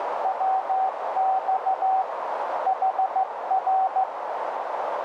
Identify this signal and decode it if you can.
Morse code, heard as a keyed tone, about 15 wpm, 760 Hz, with heavy radio static and a narrow filter. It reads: WX HR